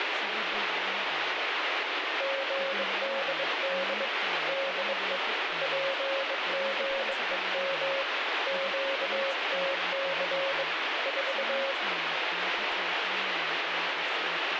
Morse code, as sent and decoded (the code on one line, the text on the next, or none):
--. -.. -.. / -.. . / .--. --. . -- / --.- - -.-. / ....-
GDD DE PGEM QTC 4